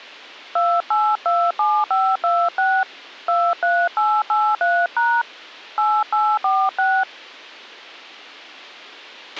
DTMF, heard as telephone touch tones, dialled by hand, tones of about 250 ms, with a squelch burst at the end. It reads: 2827526 23883# 8846